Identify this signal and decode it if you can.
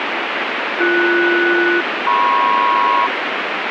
Aircraft SELCAL, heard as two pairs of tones, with radio static. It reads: BS-MP